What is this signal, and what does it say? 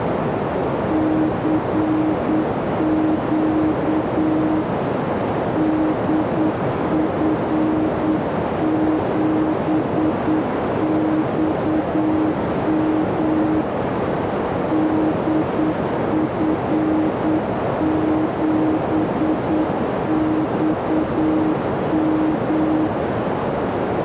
Morse code, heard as a keyed tone, hand-sent with a straight key, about 8 wpm, 310 Hz, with heavy radio static and a narrow filter. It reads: CQ DF7XM DF7XM